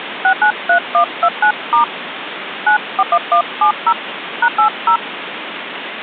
DTMF, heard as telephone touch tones, dialled by hand, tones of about 80 ms, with phone line noise. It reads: 693129* 941170 #80